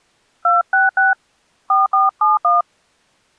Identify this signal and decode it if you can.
DTMF, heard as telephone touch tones, dialled by hand, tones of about 160 ms. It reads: 266 4471